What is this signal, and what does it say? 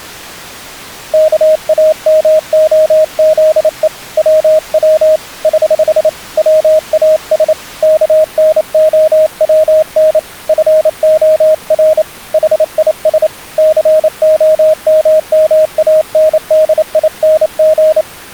Morse code, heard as a keyed tone, hand-sent with a paddle, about 28 wpm, 620 Hz. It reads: KAMOZE WW <HH> WAS KNOWN FOR HIS COMMANDING